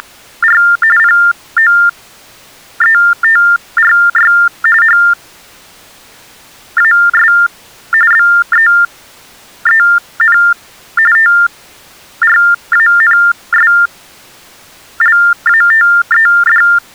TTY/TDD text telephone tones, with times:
0.0-0.6 …
1.0-4.3 POETRY
4.8-7.3 HAS
8.1-10.4 BEEN
11.2-16.6 TRANSLATED

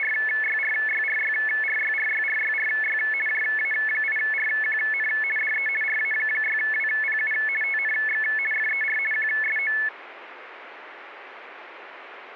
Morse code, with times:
none

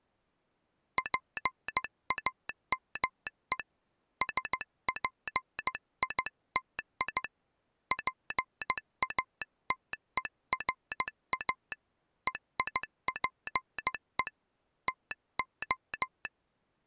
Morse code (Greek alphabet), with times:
1.0-3.6 ΠΑΜΕ
4.2-7.2 ΣΠΙΤΙ
7.9-11.7 ΠΑΤΕΡΑ
12.3-14.3 ΕΙΠΕ
14.9-16.3 ΤΟ

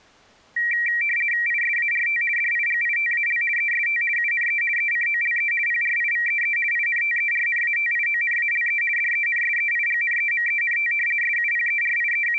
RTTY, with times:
1.5-2.2 ISART
2.4-3.4 DIGITAL
3.6-4.0 EST
4.2-4.6 UNE
4.8-5.5 ECOLE
5.7-6.6 PRIVEE
6.7-8.8 INTERNATIONALE
9.0-10.9 DENSEIGNEMENT
11.2-12.4 …

